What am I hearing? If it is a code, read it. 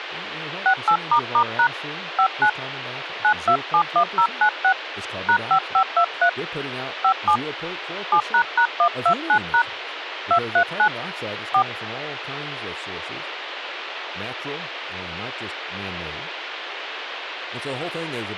DTMF, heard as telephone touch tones, dialled by hand, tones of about 80 ms, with phone line noise and speech in English. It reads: 68**# 59 9271096 #5523 57 7##129# 239 4